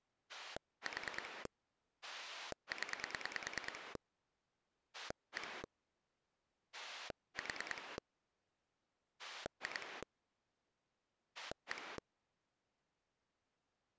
Pulse dialling, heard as a rotary dial, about 9 pulses a second. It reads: 4 0 1 4 2 1